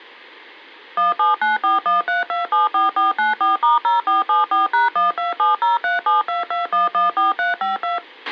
DTMF, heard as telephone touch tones, dialled by machine, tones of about 150 ms, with a squelch burst at the end. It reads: 179413274494*0474#12703722114352